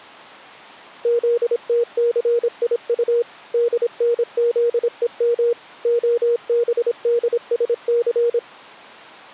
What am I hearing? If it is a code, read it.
Morse code, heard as a keyed tone, machine-sent, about 26 wpm, 470 Hz. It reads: ZTCIU DNZEM OBDSC